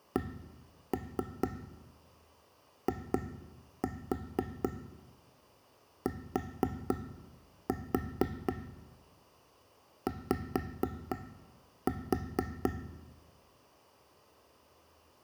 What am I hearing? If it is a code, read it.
Tap code, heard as taps on a table, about 4 knocks a second, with room echo. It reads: CITY